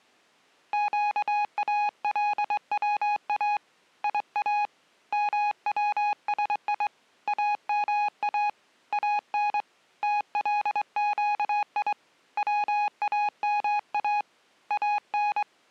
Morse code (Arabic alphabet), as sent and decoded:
--.- .- .-.. .-- .- / .. .- / -- .-- ... .. / .- -- .- / .- -. / - .-.. --.- .. / .-- .- -- .- / .- -.
قالوا يا موسي اما ان تلقي واما ان

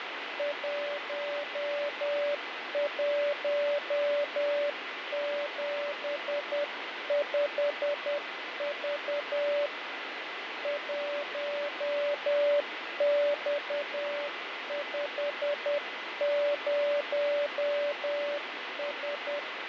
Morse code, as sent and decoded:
.---- .---- --... ..... ...- / .---- -..- ..... ----- ...
1175V 1X50S

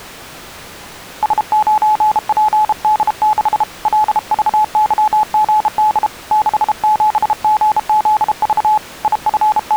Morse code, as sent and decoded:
... ----. .--. -.. -.... / .-.. ...- -.-- --. -.. / -.... --... --. --.. ...- / …
S9PD6 LVYGD 67GZV …

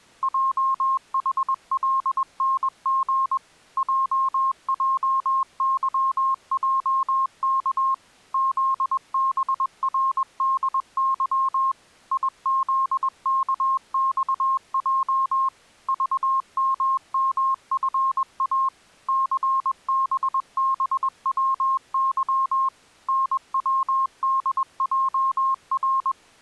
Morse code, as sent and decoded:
.--- .... .-.. -. --. / .--- .--- -.-- .--- -.- / --.. -... .-. -.. -.-- / .. --.. -.- -..- .--- / ...- -- -- ..-. .- / -.-. -... -... .-- -.-- / -. .-- -.. .--- .-.
JHLNG JJYJK ZBRDY IZKXJ VMMFA CBBWY NWDJR

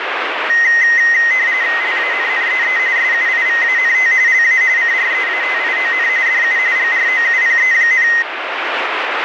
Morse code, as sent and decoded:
none

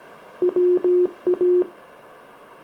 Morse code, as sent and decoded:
.-- .-
WA

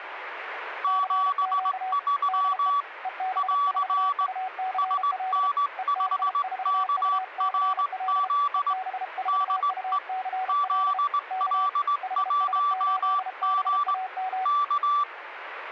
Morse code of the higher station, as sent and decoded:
--... ...-- / .-.-. / ... -. ..... -.- .-. --.. / -.. . / --.. .-.. .---- --. / -.-
73 <AR> SN5KRZ DE ZL1G K

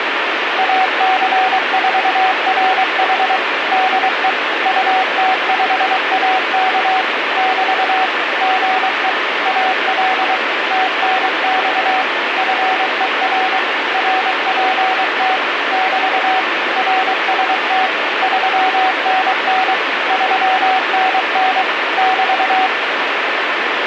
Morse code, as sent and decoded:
.- -.-. ....- .-. .... / -.. . / ..- - ..... .- -.- / -...- / --. . / .- .-.. / - -. -..- / ..-. . .-. / .-. .--. - / -...- / .-. ... - / ...-- -. -. / ...-- -. -. / -...-
AC4RH DE UT5AK <BT> GE AL TNX FER RPT <BT> RST 3NN 3NN <BT>

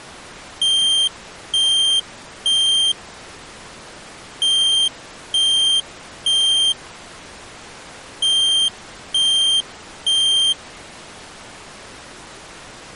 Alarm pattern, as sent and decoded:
3 beeps and a pause
temporal three

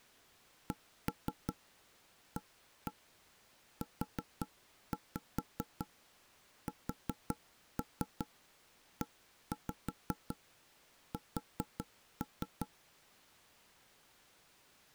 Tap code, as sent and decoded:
1-3 1-1 4-5 4-3 1-5 4-3
CAUSES

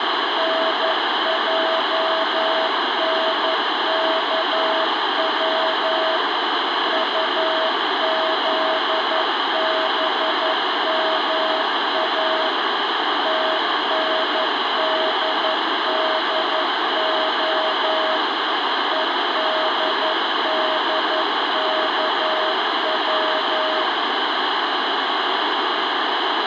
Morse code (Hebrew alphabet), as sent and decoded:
-. .--- -. -.- .-- / ..- --.. -... -- .- / - -. -.. -.. --- / . -.. -.. -.- .--
נענכץ טזבמא תנדדה ודדכץ

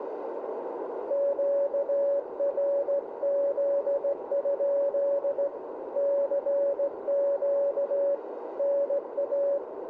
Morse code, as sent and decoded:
--.- .-. --.. ..--.. / -.-. --.- / -. .-
QRZ? CQ NA

